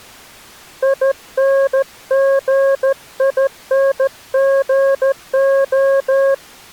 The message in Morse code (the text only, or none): INGINGO